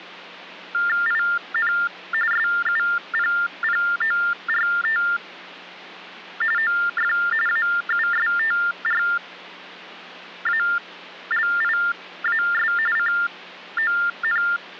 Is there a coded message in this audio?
Yes: TTY/TDD text telephone tones (45.45 baud Baudot) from 0.7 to 14.8 s, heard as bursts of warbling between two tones, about 400 Hz shift, 1600 Hz centre, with hum. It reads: IN SUPPORT OF AUSTRALIAS …